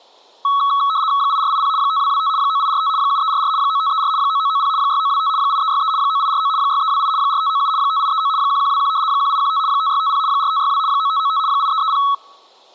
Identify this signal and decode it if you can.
RTTY (75 baud, 170 Hz shift), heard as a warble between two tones, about 1200 Hz centre. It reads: 8480 5225 9845 7344 9534 9990 6925 8363 9849 6328 4597 5839 1121 1815 5650 4562 9595 8330